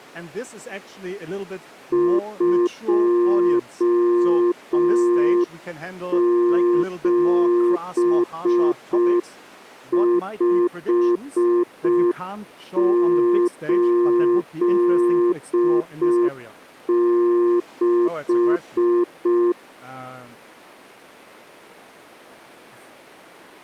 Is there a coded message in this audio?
Yes: Morse code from 1.9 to 19.6 s, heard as a keyed tone, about 5 wpm, 350 Hz. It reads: 27586